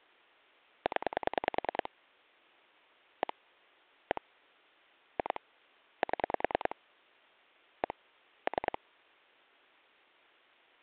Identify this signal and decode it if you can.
Pulse dialling, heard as clicks on a phone line, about 10 pulses a second. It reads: 0 1 1 2 7 1 3